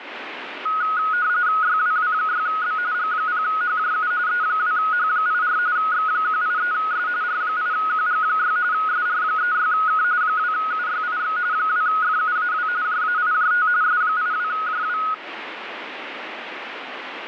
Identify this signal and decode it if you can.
RTTY (45.45 baud, 170 Hz shift), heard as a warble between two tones, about 1360 Hz centre, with radio static. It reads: YWW6B G0HJU E2H84 X183S R8QG6 SR36K 2UYIX 2FUAW JAIJT S82JW